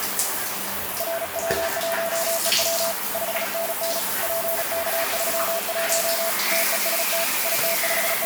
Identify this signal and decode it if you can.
Morse code, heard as a keyed tone, hand-sent with a paddle, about 36 wpm, 670 Hz, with radio static and the noise of a restroom. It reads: RW1EW 5NN PK31 TEST …